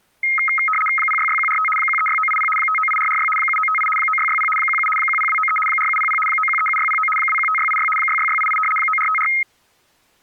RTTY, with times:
1.0-1.7 066145
1.8-2.5 136980
2.6-3.3 598446
3.4-3.9 7958
4.0-4.5 9660
4.6-4.9 17
5.0-5.6 10293
5.7-6.2 4700
6.3-7.1 9137609
7.2-7.9 215686
8.0-8.6 66688
8.8-9.3 9454

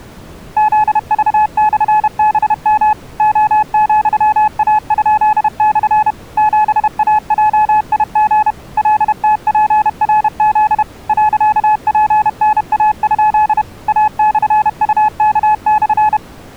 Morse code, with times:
0.6-2.9 ZV/BM
3.2-6.1 O,A?/
6.4-8.5 7AJIG
8.8-10.8 LTPRZ
11.1-13.6 .PNA?
13.9-16.2 A/UK/

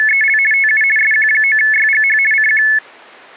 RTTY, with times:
0.0-0.4 …
0.5-0.8 TU
1.0-2.2 SQ9YGH
2.3-2.6 CQ

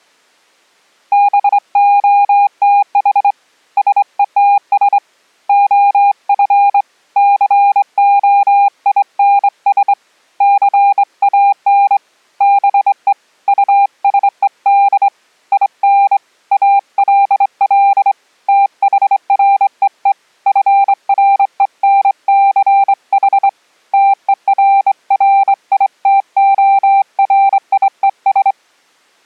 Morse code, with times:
1.1-3.3 BOTH
3.8-5.0 SETS
5.5-6.8 OF
7.2-9.9 COINS
10.4-12.0 CAN
12.4-13.1 BE
13.5-15.1 USED
15.5-16.2 IN
16.5-18.1 ALL
18.5-20.1 THREE
20.5-23.5 FRENCH
23.9-28.5 TERRITORIES

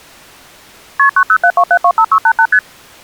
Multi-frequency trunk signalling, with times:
1.0-1.1 KP
1.2-2.5 9072725688
2.5-2.6 ST

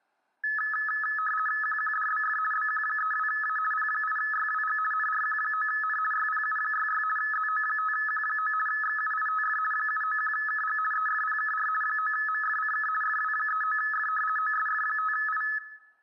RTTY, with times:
1.6-2.4 QQDBF
2.5-3.6 BQ32A
3.7-4.8 P8YWG
4.9-6.0 NRQ9N
6.1-7.0 YPU66
7.2-8.5 ZO5Q9
8.7-9.6 XUITF
9.7-10.8 791KG
10.9-11.7 EFPKR
11.8-12.9 9MFCK
13.0-14.1 FW39F
14.4-15.4 OSF5I

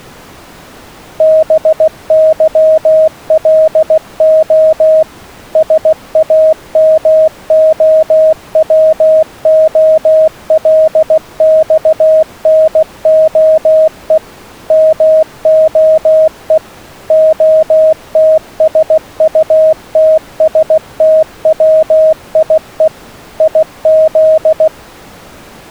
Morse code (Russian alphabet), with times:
1.2-5.0 БЫЛО
5.6-14.2 САМОВОЛЬНОЕ
14.7-16.6 МОЕ
17.1-22.9 ОТСУТСТВИЕ
23.4-24.7 ИЗ

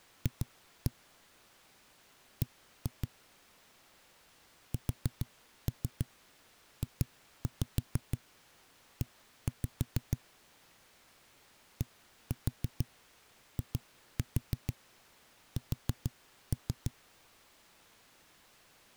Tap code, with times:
0.3-0.9 F
2.4-3.1 B
4.7-10.2 SJE
11.8-16.9 DIS

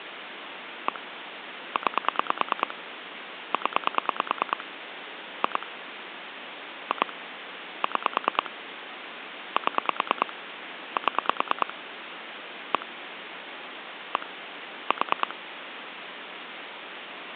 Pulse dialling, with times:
0.9-1.0 1
1.8-2.7 9
3.5-4.6 0
5.4-5.7 2
6.9-7.1 2
7.8-8.5 6
9.6-10.3 7
11.0-11.7 7
12.7-12.9 1
14.2-14.3 1
14.9-15.3 4

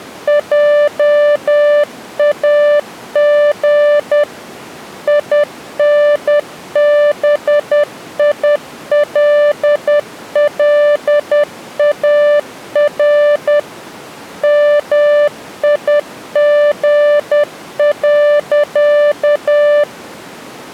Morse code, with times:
0.3-4.2 JAG
5.1-13.6 INBILLAR
14.4-19.8 MIG.

